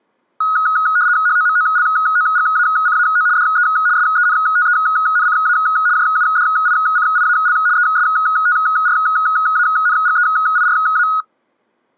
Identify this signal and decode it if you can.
RTTY (75 baud, 170 Hz shift), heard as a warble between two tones, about 1360 Hz centre. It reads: HOMOLOGACAO DE SENTENCA JUDICIAL ESTRANGEIRA